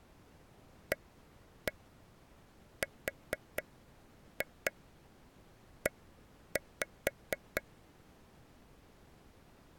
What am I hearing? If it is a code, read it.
Tap code, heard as taps on a table, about 4 knocks a second. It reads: ARE